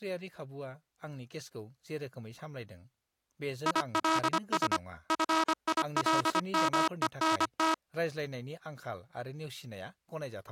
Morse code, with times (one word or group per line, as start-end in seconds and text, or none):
3.7-4.8 ILS
5.1-7.7 FILMENT